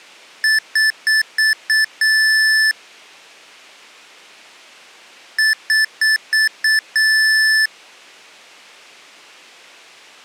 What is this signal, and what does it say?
Beep code, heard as beeps from a small speaker, played twice, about 1750 Hz. 5 short, 1 long.